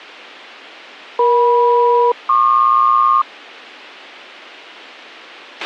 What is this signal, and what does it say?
Aircraft SELCAL, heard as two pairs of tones, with a squelch burst at the end. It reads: EM-PQ